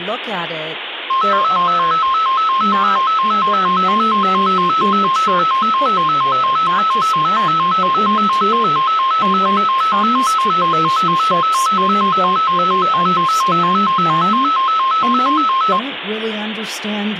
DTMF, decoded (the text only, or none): none